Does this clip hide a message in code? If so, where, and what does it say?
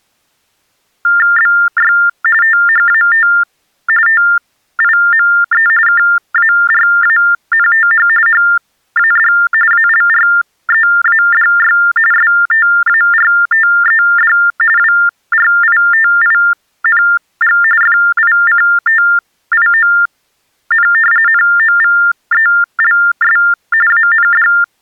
Yes: TTY/TDD text telephone tones (45.45 baud Baudot) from 1.0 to 24.6 s, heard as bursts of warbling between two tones, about 400 Hz shift, 1600 Hz centre. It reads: BY THAT TIME KARANTH HAD ALREADY STARTED WRITING FICTION NOVELS AND